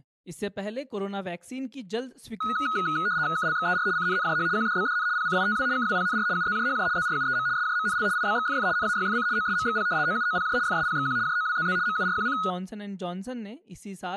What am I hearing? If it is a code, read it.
RTTY (75 baud, 170 Hz shift), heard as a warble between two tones, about 1360 Hz centre, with room echo and speech in Hindi. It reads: KLXER CNNJH QDBDN PCITW KWPNR UZJHJ ZRUEM SJMNL IBXFF NAYFC OSMXP OUOPJ FSPXQ JOWZZ MURQC